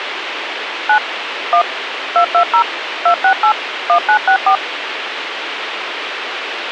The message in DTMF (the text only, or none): 9 1 220 268 1964